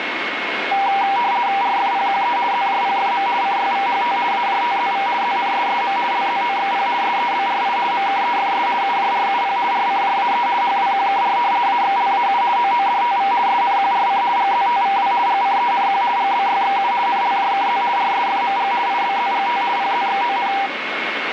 RTTY (50 baud, 170 Hz shift), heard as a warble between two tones, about 880 Hz centre, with radio static and a steady whistle near 2170 Hz. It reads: RFPQE ZJPFM CYVHT AJTZV ZNSSM LZOXP SEBRI MKEFS UJRUP RCJAE HWQKR AXLAU OODTV SNQRC GZTVW GCENQ GBYXU NLJKZ RSFMG IBZGT PZXON